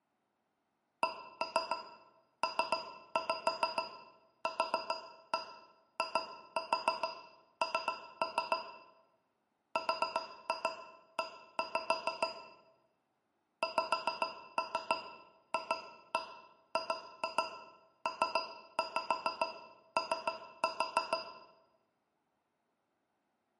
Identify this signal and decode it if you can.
Tap code, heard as taps on a metal pipe, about 6 knocks a second, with room echo. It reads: CPQIN RE XFGPO